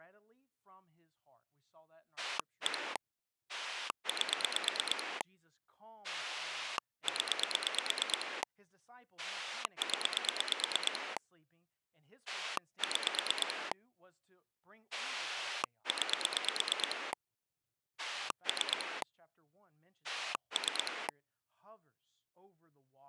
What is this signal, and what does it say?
Pulse dialling, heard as a rotary dial, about 8 pulses a second, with speech in English. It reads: 1 8 0 0 6 9 3 3